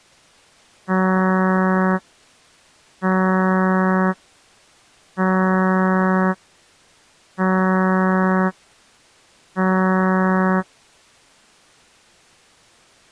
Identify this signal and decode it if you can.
Ship horn signal, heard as a ship's horn, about 190 Hz. 5 short. At sea: I doubt that you are doing enough to avoid a collision.